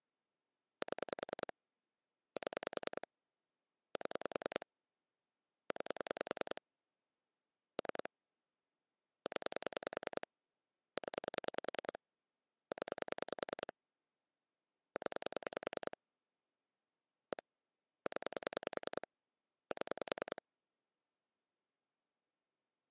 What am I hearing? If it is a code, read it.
Pulse dialling, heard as clicks on a phone line, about 10 pulses a second. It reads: 7 7 7 9 3 0 0 0 0 1 0 7